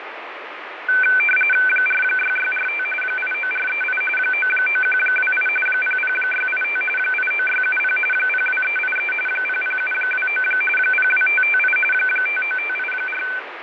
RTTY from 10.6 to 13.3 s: 02558 59584

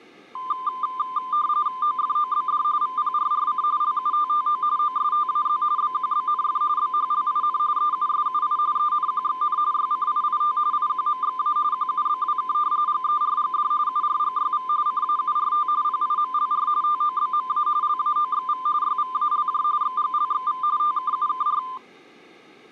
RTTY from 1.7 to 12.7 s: OFOBD VPRRC LUTTO OSTAZ BQBNF BHLIN EUSUI ENQXN YCIIT IQMXA QUBWK

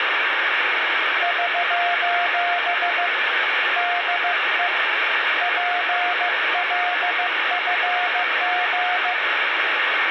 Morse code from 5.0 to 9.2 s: PLFG

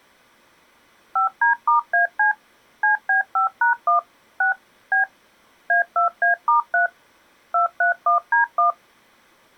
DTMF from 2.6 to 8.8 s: CB5#1 6 B A2A*3 231D1

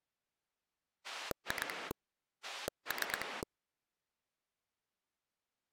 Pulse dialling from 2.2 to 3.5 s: 3

